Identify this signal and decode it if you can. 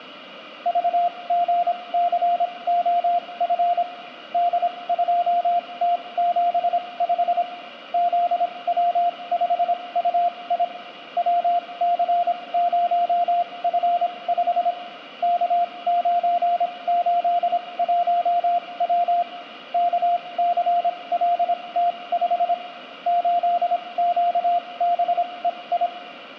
Morse code, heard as a keyed tone, machine-sent, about 26 wpm, spaced as for 21 wpm, 700 Hz, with room echo. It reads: VGCOF D2T75 ZW5UI WC0F5 K981W KCLT5 8QBEI